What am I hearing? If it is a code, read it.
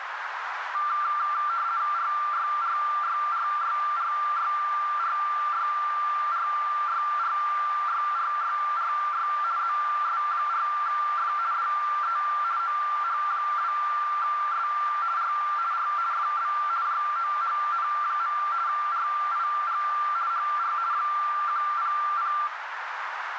RTTY (50 baud, 170 Hz shift), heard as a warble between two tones, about 1270 Hz centre, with radio static and a narrow filter. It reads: RYRYRYRYRYRYRYRYRY ZS4F DE OH2S R R FB JOHN. RIG HR 100